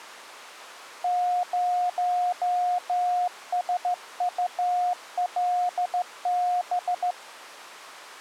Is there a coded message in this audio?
Yes: Morse code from 1.0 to 7.2 s, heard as a keyed tone, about 14 wpm, 720 Hz. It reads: 0SULB